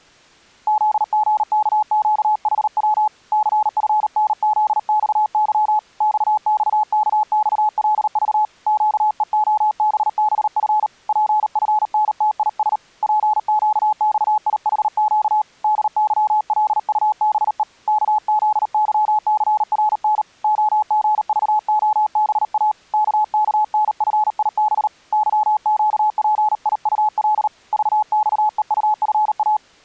Morse code, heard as a keyed tone, hand-sent with a paddle, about 38 wpm, 850 Hz. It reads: ZGKQHW CFNZXY XXKXLV QEOBBF PFNTIS PQXIHQ DYLUBE KZYCRN OGVOBA KKNFIB YQPIUL VXEUFA